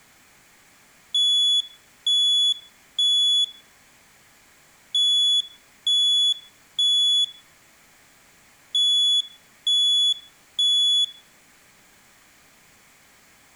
Alarm pattern, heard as an alarm's beeps, played three times, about 3400 Hz, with room echo. Temporal three. Smoke or fire, evacuate.